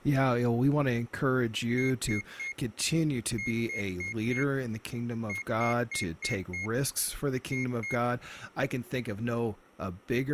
Beep code, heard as a piezo beeper, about 2150 Hz, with speech in English. 3-4-5-2.